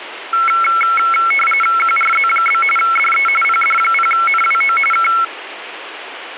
RTTY (45.45 baud, 850 Hz shift), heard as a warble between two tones, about 1750 Hz centre, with radio static. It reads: QRZ? DE PD0NWO K